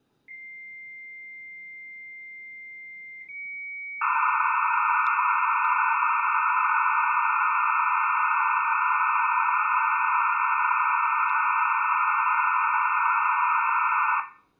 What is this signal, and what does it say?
Dial-up modem handshake (low-speed, two carriers), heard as two whistles, then hiss, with room echo.